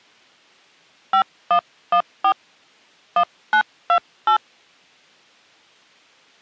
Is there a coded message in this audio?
Yes: DTMF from 1.1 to 4.4 s, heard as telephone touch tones, dialled by hand, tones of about 80 ms. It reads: 5114 1928